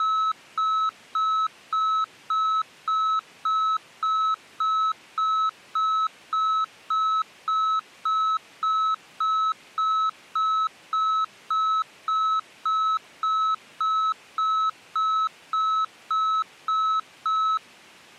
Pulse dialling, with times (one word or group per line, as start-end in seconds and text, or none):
none